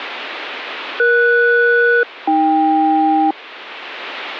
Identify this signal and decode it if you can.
Aircraft SELCAL, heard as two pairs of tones. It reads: ES-AK